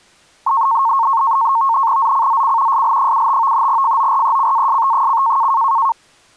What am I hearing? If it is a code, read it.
NAVTEX (SITOR-B), 100 baud, 170 Hz shift, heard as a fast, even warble, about 1000 Hz centre. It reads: ZCZC SL75 FORECAST: